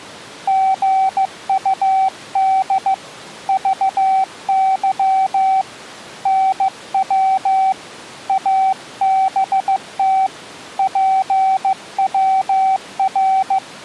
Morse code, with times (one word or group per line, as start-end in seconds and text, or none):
0.5-2.9 GUD
3.5-5.6 VY
6.3-7.7 NW
8.3-10.3 ABT
10.8-13.6 PWR